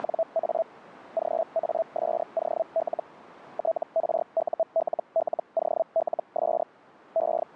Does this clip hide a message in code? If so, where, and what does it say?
Yes: Hellschreiber (Feld-Hell, 122.5 baud) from 0.0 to 7.6 s, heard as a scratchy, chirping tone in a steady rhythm, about 660 Hz, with radio static. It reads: … GASOL TRULLOLS …